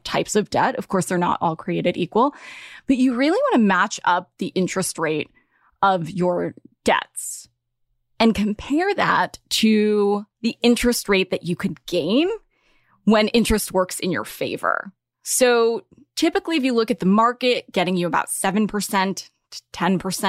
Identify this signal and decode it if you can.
Speech in English. There is no code.